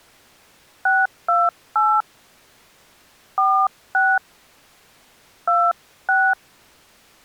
DTMF, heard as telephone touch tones, dialled by hand, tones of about 240 ms. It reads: 628 46 26